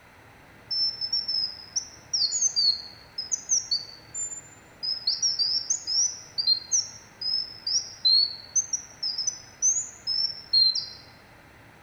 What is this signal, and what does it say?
Bird-like chirps, with room echo. There is no code.